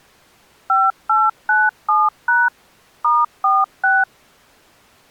DTMF, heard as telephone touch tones, dialled by machine, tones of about 200 ms. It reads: 5897# *46